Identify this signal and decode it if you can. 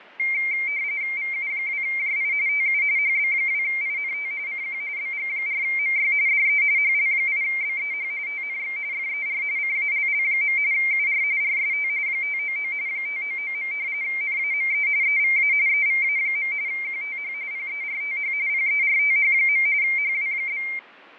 RTTY (45.45 baud, 170 Hz shift), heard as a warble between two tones, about 2200 Hz centre, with fading. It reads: VU2JI TU HB2INT CQ BG4MY DE HL8BEH TNX FER CALL. UR RST 599 599. NAME EVA EVA. QTH PERTH PERTH. HW?